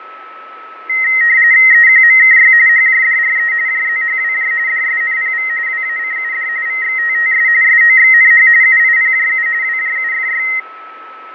RTTY (45.45 baud, 170 Hz shift), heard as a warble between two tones, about 1950 Hz centre, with radio static, fading and a steady whistle near 1300 Hz. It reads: EQMKY HJDRE JZHWJ DSNPV WACUD VXTTS SOXNH UIPJU WJUFY